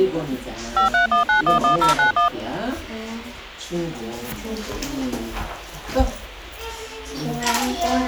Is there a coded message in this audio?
Yes: DTMF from 0.8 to 2.3 s, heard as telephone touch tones, dialled by machine, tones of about 120 ms, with the noise of a crowd indoors. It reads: 531911091